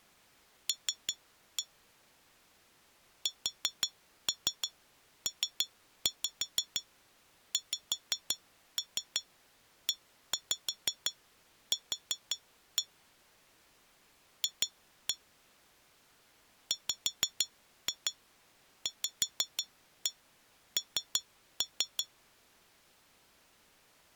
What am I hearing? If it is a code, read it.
Tap code, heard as taps on glass, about 5 knocks a second. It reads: L SPXEQ F WVN